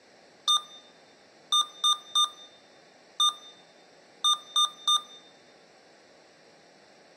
Beep code, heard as beeps from a small speaker, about 1210 Hz, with room echo. 1-3-1-3. In Phoenix BIOS tables: keyboard controller test failure.